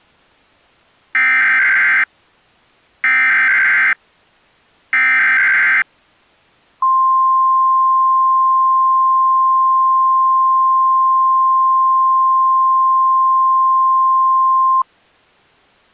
Emergency Alert System (SAME) tones (header bursts, then the 1050 Hz attention tone), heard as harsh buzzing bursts, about 520.83 baud.